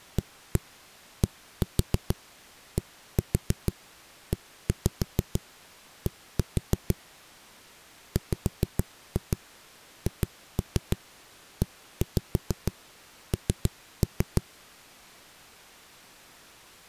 Tap code, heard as knocks on a wall, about 6 knocks a second. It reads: ADDED WHEN